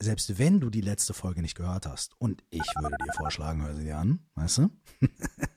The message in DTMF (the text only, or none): 925139395